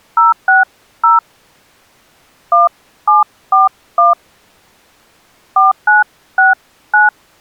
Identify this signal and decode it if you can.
DTMF, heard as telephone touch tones, dialled by hand, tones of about 160 ms. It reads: 060 1741 4969